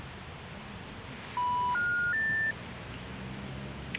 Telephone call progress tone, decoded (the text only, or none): special information tone